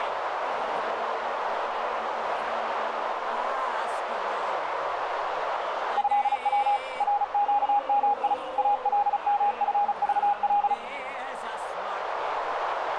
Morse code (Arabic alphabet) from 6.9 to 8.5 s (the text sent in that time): رقمي